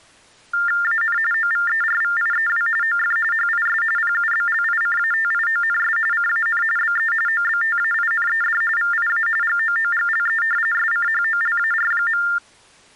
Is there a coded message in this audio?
Yes: TTY/TDD text telephone tones (45.45 baud Baudot) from 0.5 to 12.4 s, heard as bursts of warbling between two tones, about 400 Hz shift, 1600 Hz centre. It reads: AN OVERVIEW OF HIS PUBLICATIONS CAN BE OBTAINED VIA GOOGLE SCHOLAR.